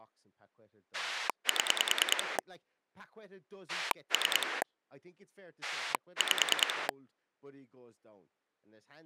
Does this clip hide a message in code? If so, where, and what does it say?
Yes: pulse dialling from 0.9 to 6.9 s, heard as a rotary dial, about 10 pulses a second, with speech in English. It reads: 7 3 5